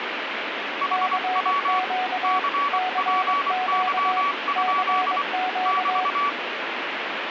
Morse code, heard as two keyed tones, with radio static. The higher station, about 24 wpm, 1140 Hz: HW CPY? <BT>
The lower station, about 22 wpm, 740 Hz: CQ CQ CQ